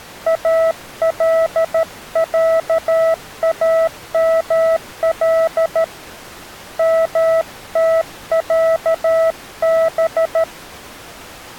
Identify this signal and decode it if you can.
Morse code (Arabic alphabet), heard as a keyed tone, hand-sent with a paddle, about 13 wpm, 650 Hz. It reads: العامل متعب